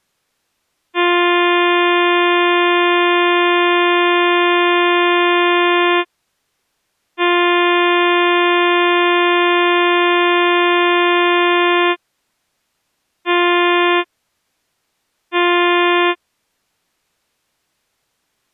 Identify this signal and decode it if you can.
Ship horn signal, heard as a ship's horn, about 350 Hz. 2 long, 2 short. At sea: I intend to overtake on your port side.